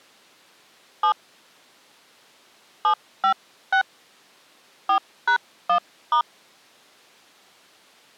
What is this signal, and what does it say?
DTMF, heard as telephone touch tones, dialled by hand, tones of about 90 ms. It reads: 7 756 4#1*